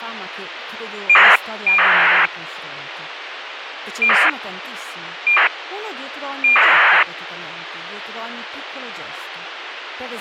ACARS aircraft data, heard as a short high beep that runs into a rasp, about 2400 baud, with radio hiss and speech in Italian.